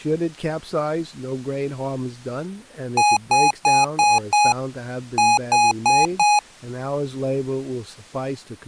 Beep code, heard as beeps from a small speaker, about 830 Hz, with speech in English. 5-4.